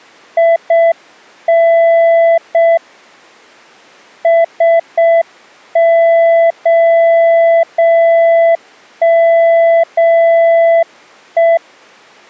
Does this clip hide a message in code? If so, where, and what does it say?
Yes: Morse code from 0.3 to 11.6 s, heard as a keyed tone, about 6 wpm, 670 Hz. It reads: IN SOME